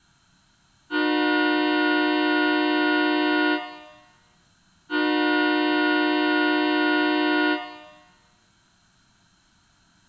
Train horn signal, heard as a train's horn, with room echo. 2 long. On North American railways: brakes released, proceed.